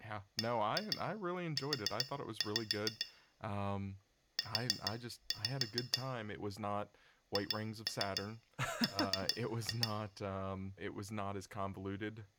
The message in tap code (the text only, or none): BU U HR